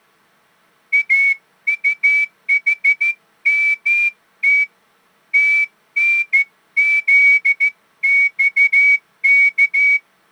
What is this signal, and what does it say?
Morse code, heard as a whistle, hand-sent with a straight key, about 14 wpm. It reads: AUHMT TNZXK